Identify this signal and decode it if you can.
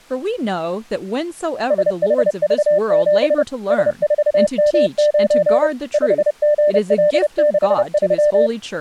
Morse code, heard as a keyed tone, machine-sent, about 30 wpm, 600 Hz, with speech in English. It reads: SHV7 S4M9 5GL63